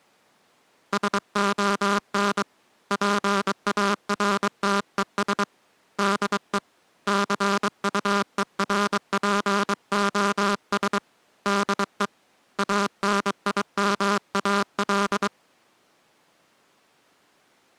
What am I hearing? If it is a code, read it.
Morse code, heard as a buzzer, hand-sent with a paddle, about 23 wpm. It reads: SON PARTES DE CUERPOS DE ANIMAL